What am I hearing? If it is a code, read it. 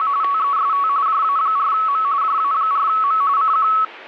RTTY (45.45 baud, 170 Hz shift), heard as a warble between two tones, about 1210 Hz centre. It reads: … TEST JA4M JA4M CQ